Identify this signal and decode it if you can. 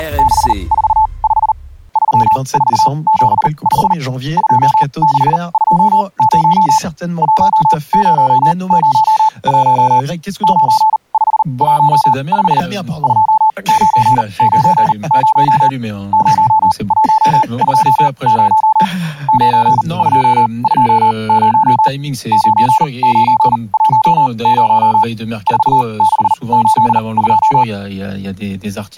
Morse code, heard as a keyed tone, machine-sent, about 39 wpm, spaced as for 28 wpm, 870 Hz. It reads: … 3475 2620 1001 9515 2990 0120 9220 9910 4682